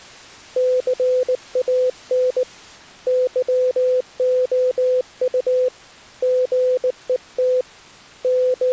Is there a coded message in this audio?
Yes: Morse code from 0.5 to 8.7 s, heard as a keyed tone, hand-sent with a bug key, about 19 wpm, 510 Hz. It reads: CAN YOU GET …